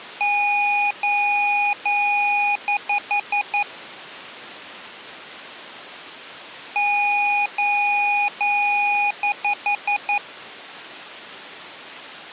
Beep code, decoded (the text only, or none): 3 long, 5 short